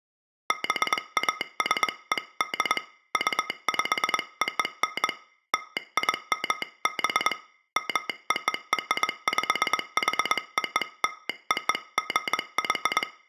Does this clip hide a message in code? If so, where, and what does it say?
Yes: Morse code (American railroad code) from 0.4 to 13.1 s, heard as a telegraph sounder, hand-sent with a straight key, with room echo. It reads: BASED UPON LIMB MORPHOLOGY